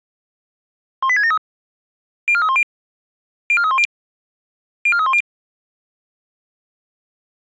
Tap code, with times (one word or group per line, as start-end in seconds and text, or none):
none